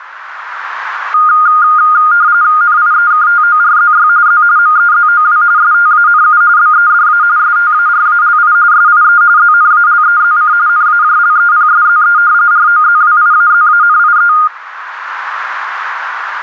RTTY (45.45 baud, 170 Hz shift), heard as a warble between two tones, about 1320 Hz centre, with radio static. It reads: NIEKTORZY Z MEZOW STANU BEDA STARALI SIE ZNALEZC NAJLEPSZE ROZWIAZANIE